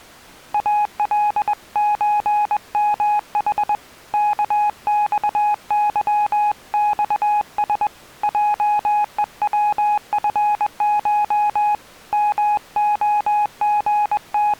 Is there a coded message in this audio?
Yes: Morse code (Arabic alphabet) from 0.5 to 14.6 s, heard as a keyed tone, hand-sent with a paddle, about 21 wpm, 840 Hz. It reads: الزمح كصظصس جءوفش …